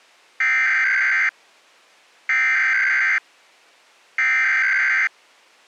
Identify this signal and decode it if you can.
Emergency Alert System (SAME) tones (header bursts), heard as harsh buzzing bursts, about 520.83 baud.